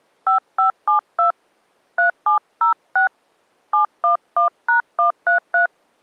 DTMF, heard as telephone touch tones, dialled by hand, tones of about 120 ms. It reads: 5572 3706 711#133